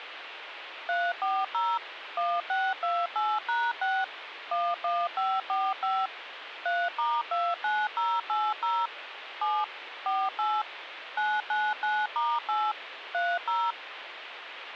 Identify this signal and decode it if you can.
DTMF, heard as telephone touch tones, dialled by machine, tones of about 230 ms, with radio hiss. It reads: 340 1628#6 11545 3*29080 7 48 999*8 30